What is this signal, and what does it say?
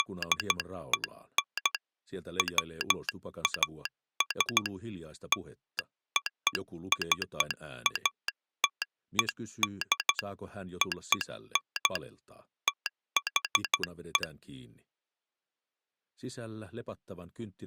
Morse code (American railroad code), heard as a telegraph sounder, hand-sent with a straight key. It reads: … WAS LOCATED ON THE